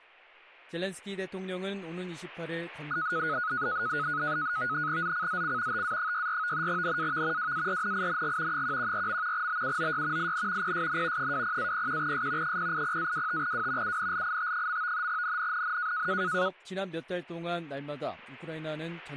NAVTEX (SITOR-B), 100 baud, 170 Hz shift, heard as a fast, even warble, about 1360 Hz centre. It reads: ZCZC TA64 NAV WARNING 114. BUOY IN PSN 20-01S 080-25W UNLIT. NNNN